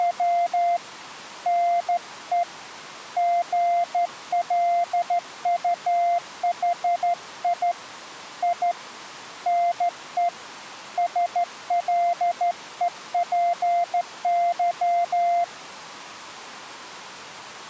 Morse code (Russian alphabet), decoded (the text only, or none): … НЕ ГЛУХИ И НЕ СЛЕПЫ